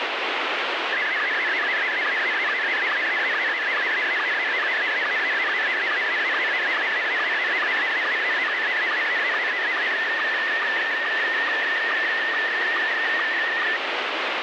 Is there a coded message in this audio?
Yes: SSTV (slow-scan television), Scottie S1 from 0.9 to 13.8 s, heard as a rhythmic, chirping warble, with heavy radio static.